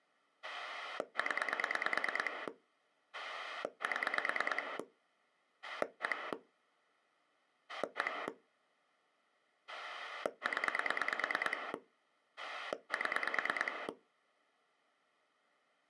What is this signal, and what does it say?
Pulse dialling, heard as a rotary dial, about 9 pulses a second. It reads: 0 7 1 1 0 7